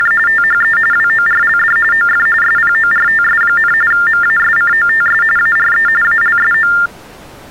TTY/TDD text telephone tones (45.45 baud Baudot), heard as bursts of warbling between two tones, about 400 Hz shift, 1600 Hz centre. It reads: … THE WORLD OF SPORTS, MASCOTS ARE ALSO